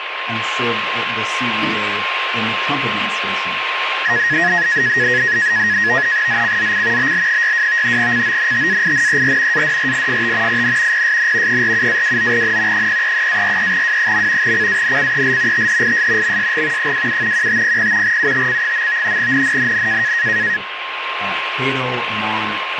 NAVTEX (SITOR-B), 100 baud, 170 Hz shift, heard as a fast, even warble, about 1800 Hz centre, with radio static and a steady whistle near 1060 Hz. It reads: ZCZC BL62 CONTAINER ADRIFT IN PSN 47-29N 033-43W. CANCEL THIS MSG 27 1500 UTC. NNNN